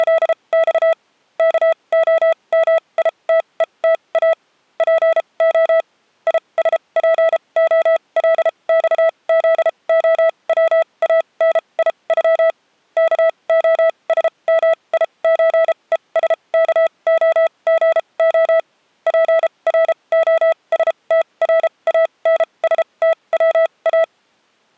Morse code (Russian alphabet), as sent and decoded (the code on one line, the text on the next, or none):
… / -.- --- -- .. - . - .- / .--. --- / .. ... .--. --- .-.. -..- --.. --- .-- .- -. .. ..-- / -.- --- ... -- .. ---. . ... -.- --- --. --- / .--. .-. --- ... - .-. .- -. ... - .-- .-
… КОМИТЕТА ПО ИСПОЛЬЗОВАНИЮ КОСМИЧЕСКОГО ПРОСТРАНСТВА